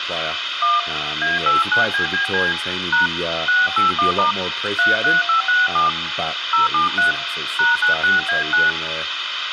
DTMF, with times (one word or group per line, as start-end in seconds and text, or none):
0.6-0.8 1
1.2-2.5 A89BBC
2.9-3.1 #
3.5-4.3 681*
4.8-5.9 33567
6.5-7.1 073
7.6-8.7 #96A9